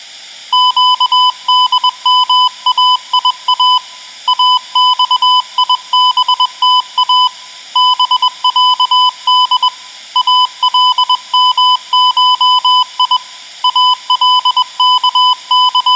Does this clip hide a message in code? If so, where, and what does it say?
Yes: Morse code (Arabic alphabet) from 0.5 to 16.0 s, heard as a keyed tone, hand-sent with a paddle, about 21 wpm, 1000 Hz, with room echo. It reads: قدمايا اصيبتا بعد المشي …